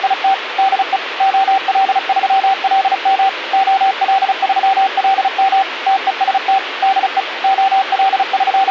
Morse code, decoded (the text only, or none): … DE OL3LM OL3LM TEST DE …